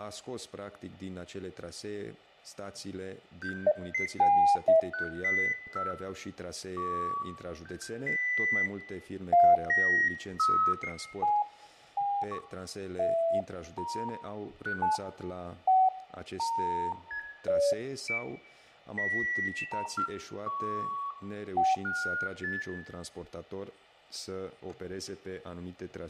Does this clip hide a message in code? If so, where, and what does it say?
No, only electronic bleeps of random pitch and length, with fading and room echo.